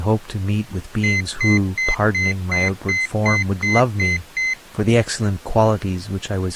Beep code, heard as a piezo beeper, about 2050 Hz, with speech in English. 10 short. In AMI BIOS tables: CMOS shutdown register error.